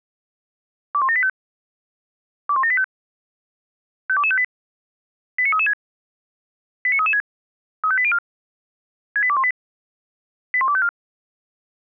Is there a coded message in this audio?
Yes: five-tone selective call (ZVEI) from 0.9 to 10.9 s, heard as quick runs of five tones, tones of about 70 ms. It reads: 21785 21785 52258 89336 89336 35804 68218 81254